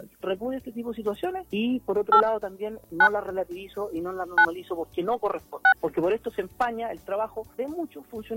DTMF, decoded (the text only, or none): 8 9 9 6